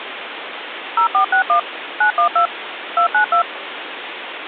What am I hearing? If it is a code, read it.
DTMF, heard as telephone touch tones, dialled by machine, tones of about 100 ms, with phone line noise. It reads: 0461 912 292